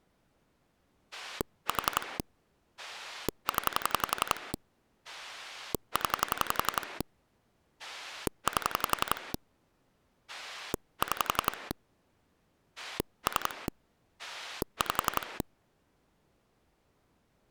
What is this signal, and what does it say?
Pulse dialling, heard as a rotary dial, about 11 pulses a second. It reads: 4 0 0 8 6 3 5